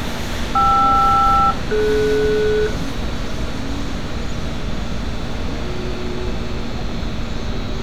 Aircraft SELCAL, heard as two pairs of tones, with street noise. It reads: KR-DS